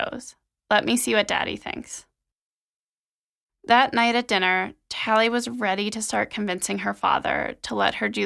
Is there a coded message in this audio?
No, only speech in English.